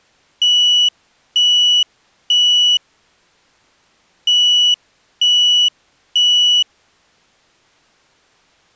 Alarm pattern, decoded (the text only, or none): temporal three